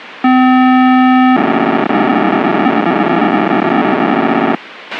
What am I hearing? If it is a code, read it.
POCSAG pager data (512 baud), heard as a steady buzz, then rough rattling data, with radio hiss and a squelch burst at the end.